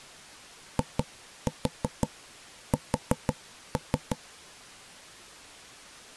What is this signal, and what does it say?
Tap code, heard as knocks on wood, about 6 knocks a second. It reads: IS